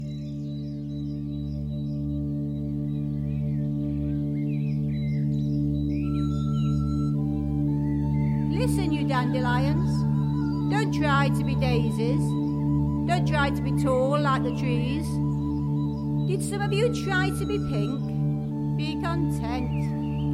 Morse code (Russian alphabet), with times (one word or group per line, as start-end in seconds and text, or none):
none